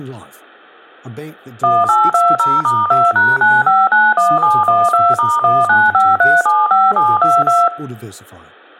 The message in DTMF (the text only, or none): 1820*2#9591712*195375722